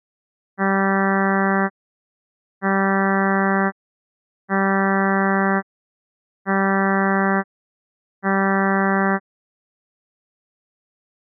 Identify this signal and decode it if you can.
Ship horn signal, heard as a ship's horn, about 200 Hz. 5 short. At sea: I doubt that you are doing enough to avoid a collision.